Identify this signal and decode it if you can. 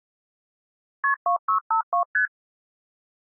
Multi-frequency trunk signalling (R1, as on North American trunks), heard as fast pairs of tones, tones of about 100 ms. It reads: KP 2652 ST